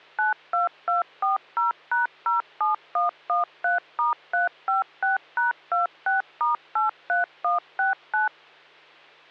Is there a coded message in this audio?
Yes: DTMF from 0.2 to 8.3 s, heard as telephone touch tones, dialled by machine, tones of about 140 ms, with hum. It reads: 92240#07113*356#26*83169